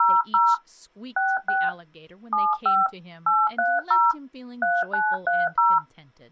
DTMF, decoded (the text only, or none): 00 66 75 830 3930